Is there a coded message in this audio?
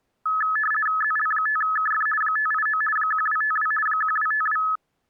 Yes: RTTY (50 baud, 450 Hz shift) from 0.3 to 4.8 s, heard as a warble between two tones, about 1500 Hz centre. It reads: ZL5KF 589 1252 1252